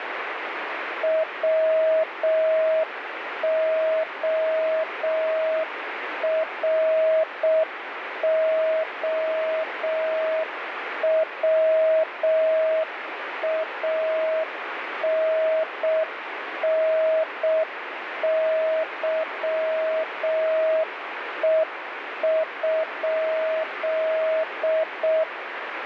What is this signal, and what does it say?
Morse code (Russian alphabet), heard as a keyed tone, machine-sent, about 6 wpm, 640 Hz, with radio static. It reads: ВОРОВАННЫЕ?